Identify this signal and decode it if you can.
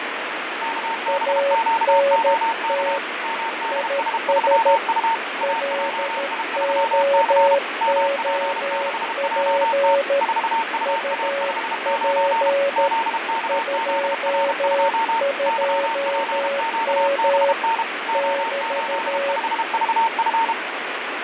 Morse code, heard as two keyed tones, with heavy radio static and fading. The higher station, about 32 wpm, 910 Hz: KBQOK MDS3U AJI3C MP6JT 4UA59 ZKZR2 YPQBN O85VF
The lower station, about 13 wpm, 560 Hz: ANT IS LOOP UP 22M <BT>